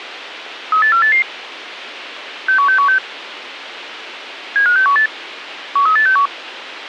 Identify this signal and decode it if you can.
Five-tone selective call (CCIR), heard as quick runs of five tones, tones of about 100 ms, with radio hiss. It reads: 38488 61616 75618 13861